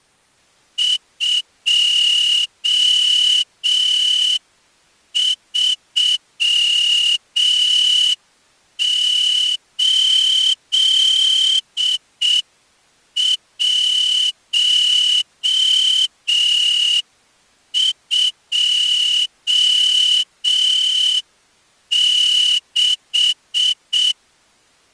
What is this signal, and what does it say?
Morse code, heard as a whistle, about 6 wpm. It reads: 238126